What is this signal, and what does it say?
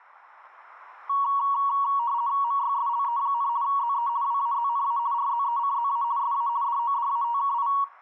RTTY (50 baud, 170 Hz shift), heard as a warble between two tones, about 1030 Hz centre. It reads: MYSLE, ZE WAZNA RZECZA SA DODATKI